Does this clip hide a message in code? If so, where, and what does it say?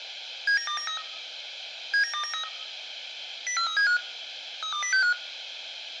Yes: five-tone selective call (CCIR) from 0.5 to 5.1 s, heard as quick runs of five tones, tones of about 100 ms. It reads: 79293 79293 04375 32065